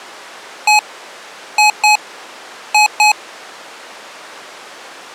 Beep code, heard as beeps from a small speaker, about 840 Hz. 1-2-2. In Phoenix BIOS tables: DMA initialisation failure.